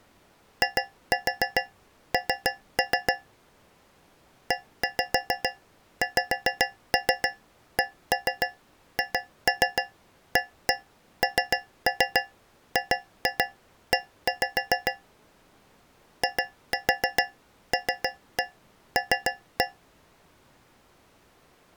Tap code, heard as taps on a metal pipe, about 7 knocks a second. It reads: IN EXCHANGE ILL